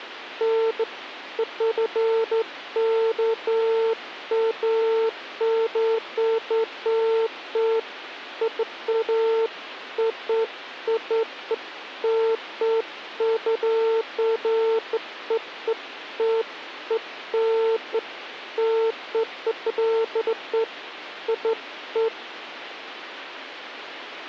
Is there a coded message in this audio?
No, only beeps of irregular length, with phone line noise.